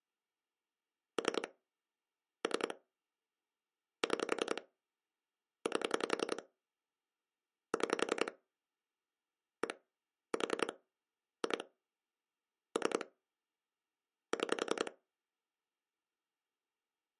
Pulse dialling, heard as clicks on a phone line, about 10 pulses a second. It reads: 3 3 6 8 6 1 4 2 3 6